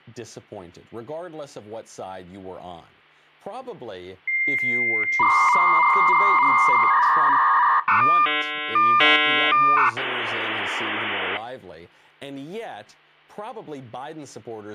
Dial-up modem handshake (V.34 or later), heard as a whistle, warbles, then hiss, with hum and speech in English.